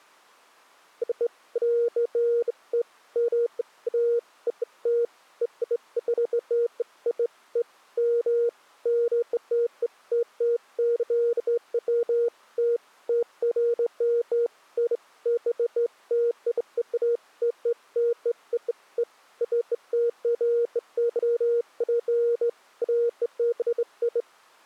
Beeps of irregular length. There is no code.